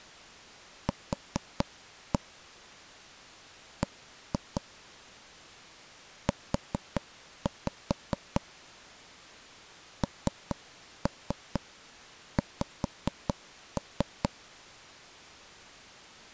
Tap code, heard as taps on a table, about 4 knocks a second. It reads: Q B U NX